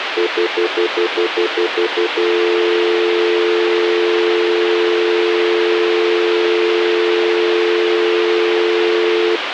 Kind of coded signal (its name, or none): telephone call progress tone